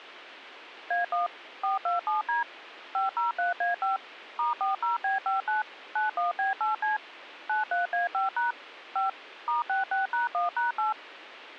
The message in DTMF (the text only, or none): A1 427D 503A5 *40B59 91B8C 93A5# 5 *66#1#8